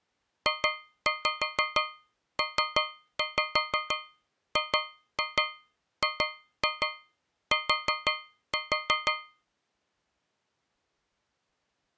Tap code, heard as taps on a metal pipe, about 6 knocks a second. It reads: JPGGT